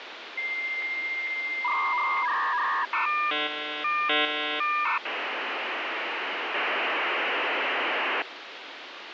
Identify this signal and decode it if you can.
Dial-up modem handshake (V.34 or later), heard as a whistle, warbles, then hiss, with phone line noise.